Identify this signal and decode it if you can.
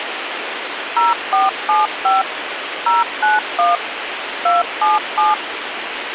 DTMF, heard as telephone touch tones, dialled by machine, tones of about 170 ms, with radio hiss. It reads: 0475 091 277